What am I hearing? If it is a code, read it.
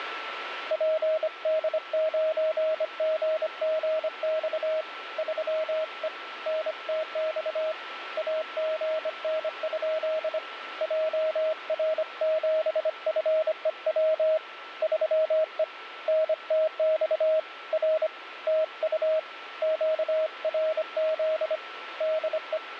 Morse code, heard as a keyed tone, hand-sent with a bug key, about 25 wpm, 630 Hz, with radio static and a steady whistle near 1340 Hz. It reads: PD9GGX 3E NTX AGN? JR7FEW 3E NTX R TU QRZ DE